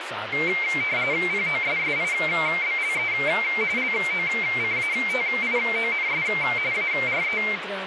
RTTY (45.45 baud, 170 Hz shift), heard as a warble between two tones, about 2200 Hz centre, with radio static and speech in Goan Konkani. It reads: POSSIBLE LOCATIONS ARE